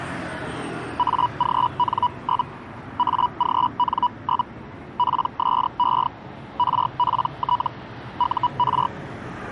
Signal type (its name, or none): Hellschreiber